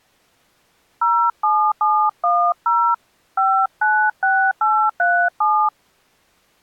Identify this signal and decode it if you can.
DTMF, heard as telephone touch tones, dialled by hand, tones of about 290 ms. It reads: 07710 596837